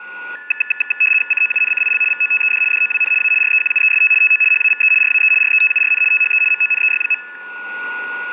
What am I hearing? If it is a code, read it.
RTTY (75 baud, 850 Hz shift), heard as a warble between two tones, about 2150 Hz centre, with static crashes and a steady whistle near 1450 Hz. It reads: COUNCIL VOTED DOWN A REQUEST TO HAVE RAE RETURN THE MONEY.